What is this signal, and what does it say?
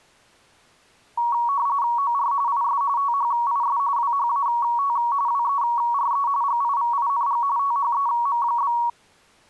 RTTY (45.45 baud, 170 Hz shift), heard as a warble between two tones, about 1030 Hz centre. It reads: OR IS THIS WHAT WERE GIVING THEM?